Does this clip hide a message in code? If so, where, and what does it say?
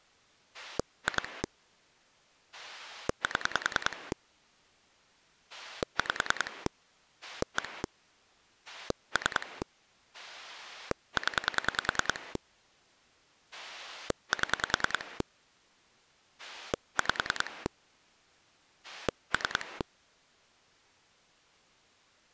Yes: pulse dialling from 0.5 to 19.8 s, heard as a rotary dial, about 10 pulses a second. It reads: 2 7 5 1 3 0 7 5 3